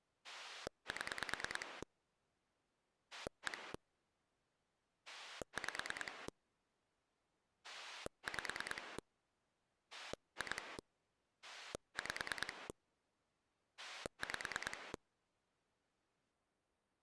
Pulse dialling, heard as a rotary dial, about 9 pulses a second. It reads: 7 1 5 5 2 5 5